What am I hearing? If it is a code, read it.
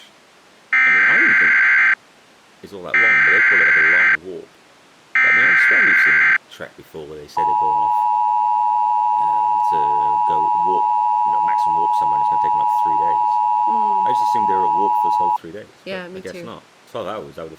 Emergency Alert System (SAME) tones (header bursts, then the 853 and 960 Hz attention tone), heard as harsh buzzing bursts, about 520.83 baud, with speech in English.